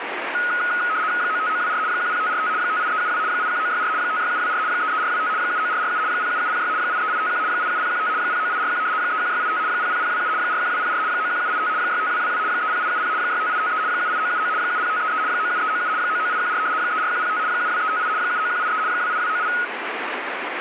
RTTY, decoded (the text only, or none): 95924 10545 58372 81964 56724 33425 79447 07706 83851 87015 09841 31685 00027 41204 91785 65222 30870 65853 78979 70533 97397 99814 34105 72358 79183 28298